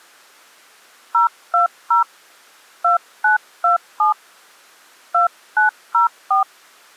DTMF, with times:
1.1-2.0 020
2.8-4.1 2927
5.1-6.4 2904

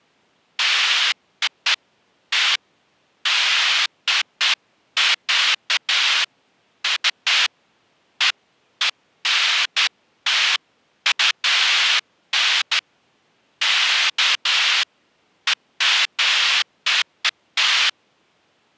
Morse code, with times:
none

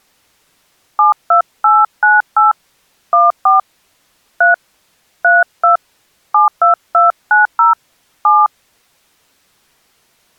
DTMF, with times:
1.0-2.5 72898
3.1-3.6 14
4.4-4.5 3
5.2-5.8 32
6.3-7.7 72290
8.2-8.5 7

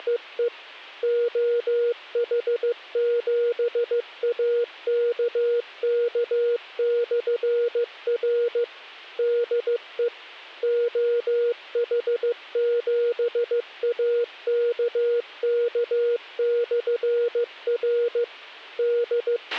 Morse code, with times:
0.0-0.5 …
1.0-8.6 OH7AKK/R
9.2-10.1 DE
10.6-18.2 OH7AKK/R
18.8-19.6 …

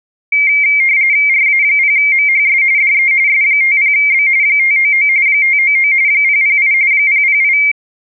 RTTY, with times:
1.3-2.6 RA0MHS
2.8-3.1 DE
3.3-4.3 S50B
4.4-5.1 599
5.3-5.9 599
6.1-6.7 008
6.9-7.6 008

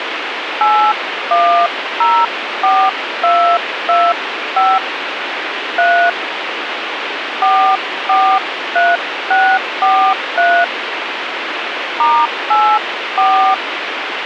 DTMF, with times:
0.6-4.8 8104225
5.8-6.1 3
7.4-10.6 443643
12.0-13.5 *84

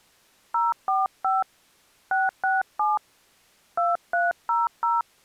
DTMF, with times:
0.5-1.4 045
2.1-3.0 667
3.8-5.0 2300

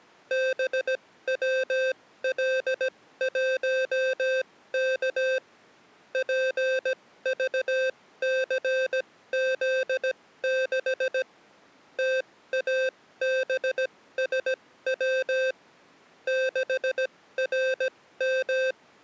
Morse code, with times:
0.3-5.4 BWL1K
6.1-11.2 PVCZ6
12.0-15.5 TABSW
16.3-19.0 …

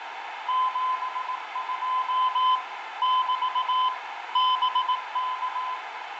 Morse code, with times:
0.5-2.6 72
3.0-3.9 <BT>
4.4-5.8 BK

